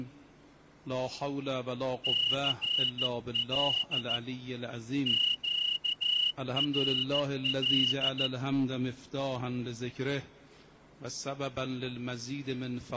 Morse code, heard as a whistle, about 14 wpm. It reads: CL QRL